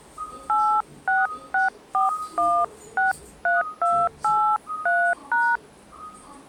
DTMF, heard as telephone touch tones, dialled by hand, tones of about 230 ms, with the noise inside a lift. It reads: 8664163283#